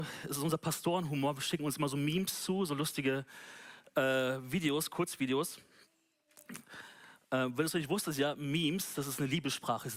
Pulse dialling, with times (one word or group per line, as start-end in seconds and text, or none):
none